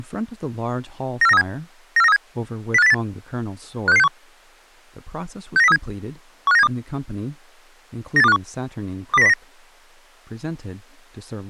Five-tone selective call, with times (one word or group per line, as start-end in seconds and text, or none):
1.2-1.4 94937
2.0-2.2 94937
2.7-2.9 05808
3.9-4.1 56661
5.6-5.8 69037
6.5-6.7 15972
8.2-8.4 98251
9.1-9.3 20909